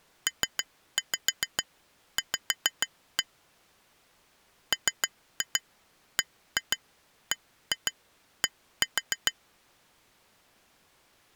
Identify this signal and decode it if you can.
Tap code, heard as taps on glass, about 6 knocks a second. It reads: PV MBBD